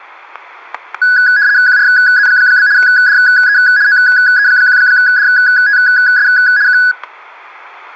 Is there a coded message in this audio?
Yes: RTTY (75 baud, 170 Hz shift) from 1.0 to 6.9 s, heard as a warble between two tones, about 1600 Hz centre, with static crashes. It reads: QRZ? DE OE1DTS K